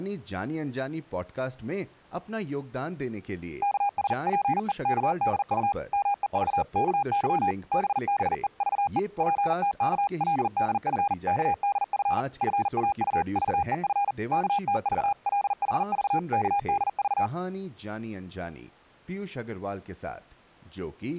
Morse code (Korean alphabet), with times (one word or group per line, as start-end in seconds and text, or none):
3.6-5.7 여자의
5.9-7.5 말에
7.7-9.0 따라
9.2-12.2 정근은
12.4-14.1 뇌란
14.3-17.3 얼굴을